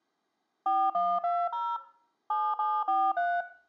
DTMF, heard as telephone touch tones, dialled by machine, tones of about 240 ms, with room echo. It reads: 4120 7743